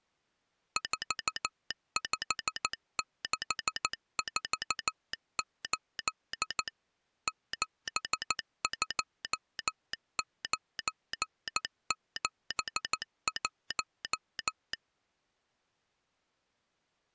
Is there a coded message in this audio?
Yes: Morse code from 0.7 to 14.8 s, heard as a telegraph sounder, machine-sent, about 14 wpm. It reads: 45648 72971